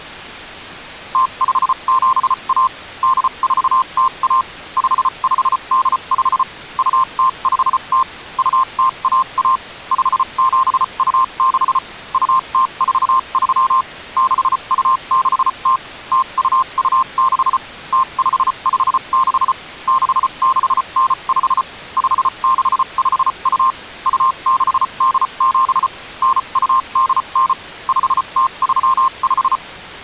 Morse code (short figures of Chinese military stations), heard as a keyed tone, machine-sent, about 34 wpm, spaced as for 29 wpm, 1050 Hz. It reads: 0571 8401 5585 2050 2011 5726 2043 6260 0226 0556 6695 5652 2687 9289 5035